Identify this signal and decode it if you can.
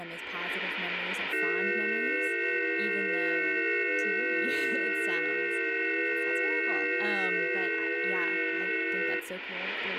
FT8 (several signals at once), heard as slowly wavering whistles, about 6.25 baud, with radio static and speech in English.